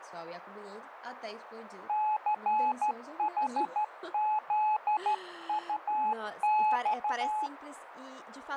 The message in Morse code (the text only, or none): CHZUX